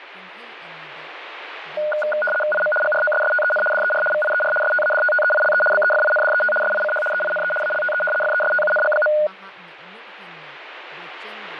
RTTY (75 baud, 850 Hz shift), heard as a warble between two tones, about 1030 Hz centre, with radio static and speech in Manipuri. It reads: IM GROSSTEN DER VIER STADTTEILE BEFINDET SICH EINE ALTE FESTUNG.